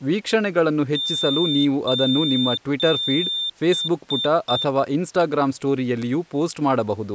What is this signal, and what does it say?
Beep code, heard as a piezo beeper, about 3600 Hz, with speech in Kannada. 3 long, 3 short.